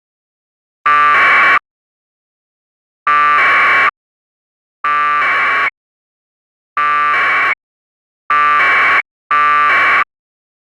Packet radio (AX.25, as in APRS), 1200 baud, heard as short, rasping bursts.